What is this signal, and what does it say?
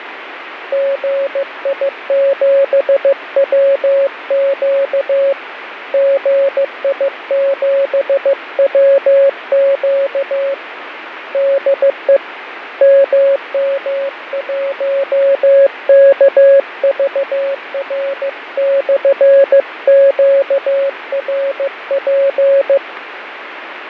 Morse code, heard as a keyed tone, hand-sent with a paddle, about 15 wpm, 550 Hz, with radio static and fading. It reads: GI7WQ GI7WQ DE MM1KVR/QRP